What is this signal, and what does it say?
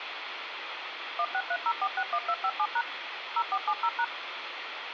DTMF, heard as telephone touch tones, dialled by machine, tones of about 60 ms, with phone line noise. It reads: 1630461257# 0470#